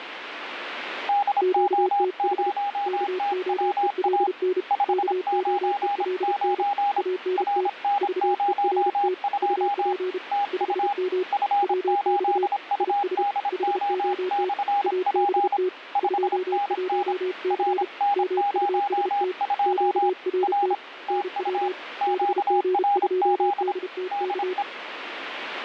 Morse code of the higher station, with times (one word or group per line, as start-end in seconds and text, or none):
1.1-4.3 DO0TWA
4.7-7.0 599
7.4-9.9 RN02
10.3-10.9 TU
11.3-15.6 F8UDO/P
16.0-17.1 5NN
17.5-20.1 RN02
20.4-20.7 R
21.1-21.7 TU
22.0-23.7 QRZ
24.1-24.6 DE